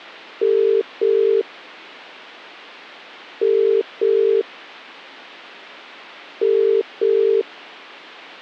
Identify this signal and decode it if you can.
Telephone call progress tone (as in the UK, Ireland, Australia and similar networks), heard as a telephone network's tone, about 400, 450 Hz. Ringback tone.